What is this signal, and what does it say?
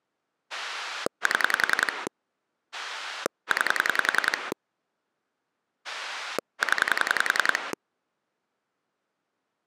Pulse dialling, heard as a rotary dial, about 10 pulses a second. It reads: 7 9 0